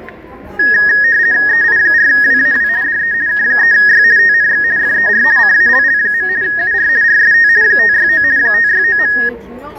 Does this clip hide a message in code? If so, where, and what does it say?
Yes: RTTY (50 baud, 170 Hz shift) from 0.6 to 9.3 s, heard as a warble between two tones, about 1750 Hz centre, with fading, static crashes and the noise of a crowd indoors. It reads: EI4WAW DE K3Y TNX FER CALL. UR RST 569 569.